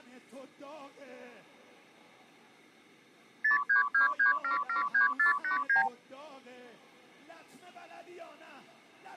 Multi-frequency trunk signalling (R2, with the far end's replies), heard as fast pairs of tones, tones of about 120 ms. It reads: 0323773489